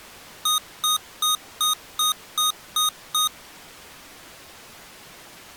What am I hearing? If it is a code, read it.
Beep code, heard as beeps from a small speaker, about 1240 Hz. 8 short. In AMI BIOS tables: display memory failure; in Dell tables: LCD failure.